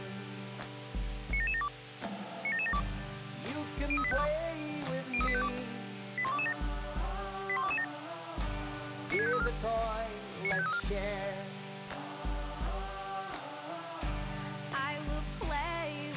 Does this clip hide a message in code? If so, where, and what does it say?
Yes: five-tone selective call (ZVEI) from 1.3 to 10.8 s, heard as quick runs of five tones, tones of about 70 ms, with radio hiss. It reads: 97772 97772 03852 03852 81227 81227 96534 96534